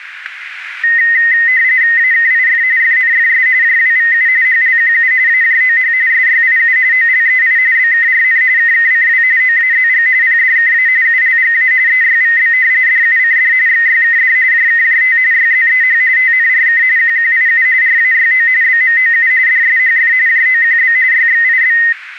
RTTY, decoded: AKIF FNFS JWVU HLQU AJOH SYIU OLEI BKRN KKCW OAZG PDKA ULGA EYVB DUCD XYKD JKJT YZEH TNRK QQIU RAYO BMOU DSHF JOQB YXIB

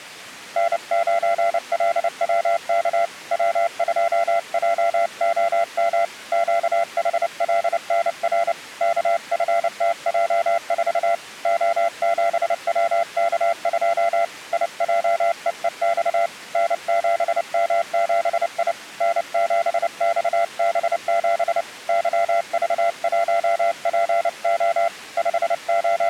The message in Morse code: N9LWK W2JOM QHLNR KFTJ4 O7WK2 IJEEX N7M7I N7XB7 YV1PO …

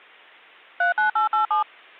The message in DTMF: 39887

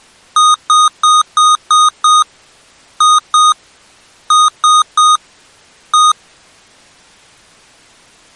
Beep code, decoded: 6-2-3-1

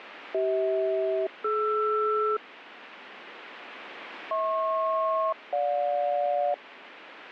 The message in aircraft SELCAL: CH-DR HP-GJ

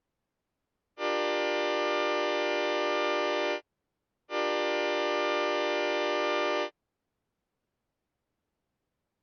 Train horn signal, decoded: 2 long

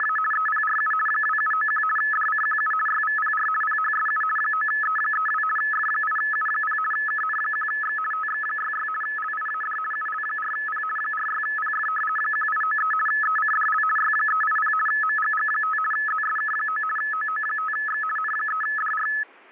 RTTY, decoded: … EPRU 2791 DCQU YVPR PHSU 9E32 F8U0 KN1X TX66 LIAD UL4P 46PF 1893 ECDL Y380 MGG5 ZSK9 OO5X N3DR

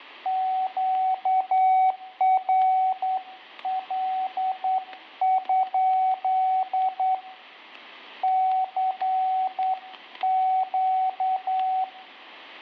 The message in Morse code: QRL? CQ

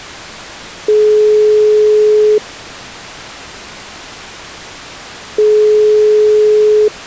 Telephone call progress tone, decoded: ringback tone

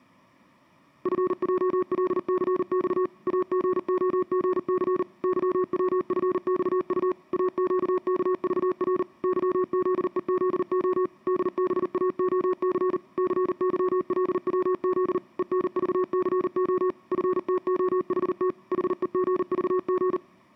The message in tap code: none

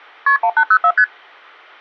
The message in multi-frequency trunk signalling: KP 1804 ST

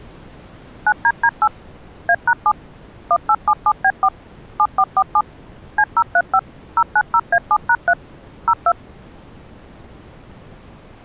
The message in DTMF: 9DD8 A#7 1877B4 7447 C035 090A7#3 02

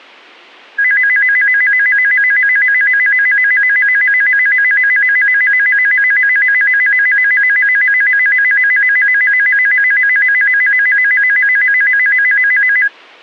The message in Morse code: none

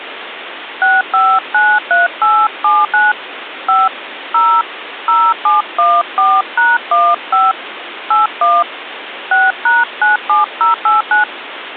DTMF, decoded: 6593879 5 0 0714#15 81 6#97089

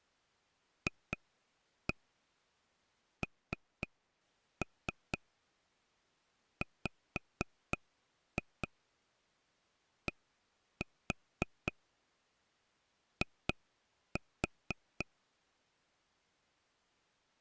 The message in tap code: FNWDI

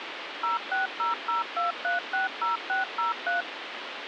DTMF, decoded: 06002360603

